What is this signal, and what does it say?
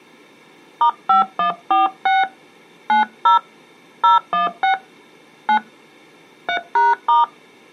DTMF, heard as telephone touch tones, dialled by hand, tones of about 140 ms. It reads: *5146 90 016 9 3#*